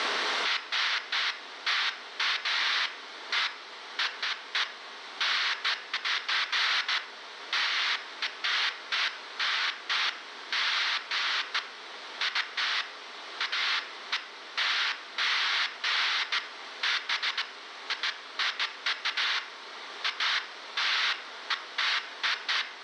Bursts of noise, with radio static and room echo. There is no code.